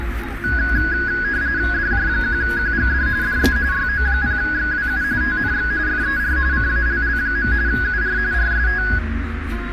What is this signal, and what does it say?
RTTY (45.45 baud, 170 Hz shift), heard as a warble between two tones, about 1550 Hz centre, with radio static, a narrow filter and the noise inside a car. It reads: DJ1QGD DE YO0XWU TNX FER CALL. UR RST